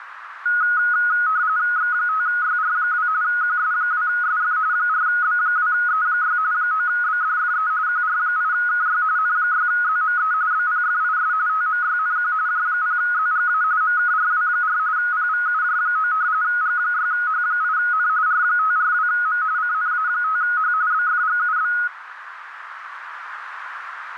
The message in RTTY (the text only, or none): X5YR2 QS2SF 4B2E6 9BDFE QR8KY N6ZME BPFIS TMYNQ J0ZGA MKRW4 PVUJ9 G6H8N R542M CNA5H BFGUB